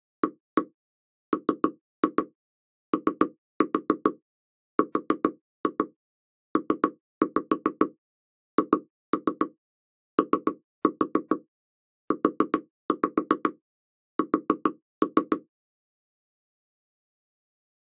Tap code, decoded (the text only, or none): AMORPHOUS